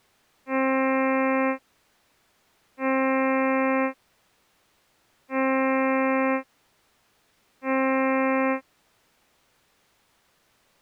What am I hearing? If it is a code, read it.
Ship horn signal, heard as a ship's horn, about 260 Hz. 4 short. At sea: a pilot vessel's identity signal in fog.